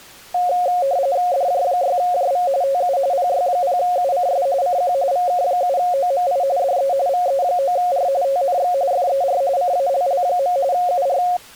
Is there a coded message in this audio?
Yes: RTTY (45.45 baud, 170 Hz shift) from 0.3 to 11.4 s, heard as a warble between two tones, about 630 Hz centre. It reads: DJ6JV TU PY0UCS CQ VK7OMI DE VE9R TNX FER CALL. UR